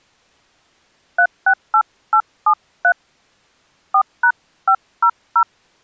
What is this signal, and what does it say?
DTMF, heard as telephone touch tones, dialled by hand, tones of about 80 ms. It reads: 368873 4#500